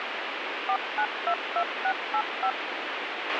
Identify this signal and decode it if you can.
DTMF, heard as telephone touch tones, dialled by machine, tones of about 70 ms, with radio hiss and a squelch burst at the end. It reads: 4922685